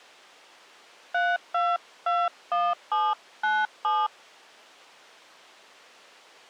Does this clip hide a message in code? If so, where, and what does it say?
Yes: DTMF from 1.1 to 4.1 s, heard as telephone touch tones, dialled by hand, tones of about 220 ms. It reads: 3221797